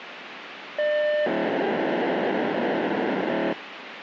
POCSAG pager data (1200 baud), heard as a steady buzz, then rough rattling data, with radio hiss.